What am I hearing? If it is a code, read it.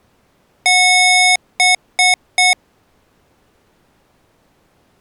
Beep code, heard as beeps from a small speaker, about 730 Hz. 1 long, 3 short. In Award and IBM BIOS tables: video adapter failure; in AMI BIOS tables: memory failure.